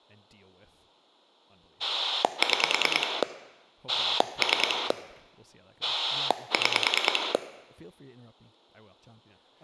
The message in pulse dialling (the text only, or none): 6 3 6